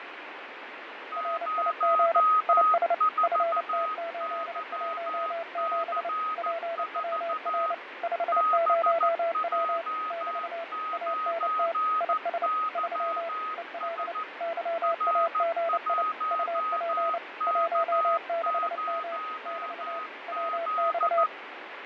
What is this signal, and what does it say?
Morse code, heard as two keyed tones, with radio static and fading. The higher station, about 14 wpm, 1260 Hz: 04YC4 BJ9YS R1K0Z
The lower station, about 29 wpm, 670 Hz: RIG IS FT817 PWR 50W <BT> ANT IS 3 EL YAGI UP 16M <BT> WX